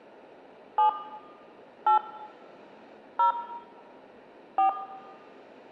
DTMF, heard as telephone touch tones, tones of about 110 ms, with room echo. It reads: 7 8 0 4